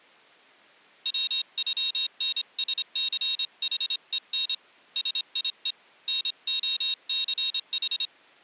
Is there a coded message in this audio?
Yes: Morse code (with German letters) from 1.0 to 8.1 s, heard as a high beeper, hand-sent with a straight key, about 26 wpm, 3750 Hz. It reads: WÜNSCHEN SIE NOCH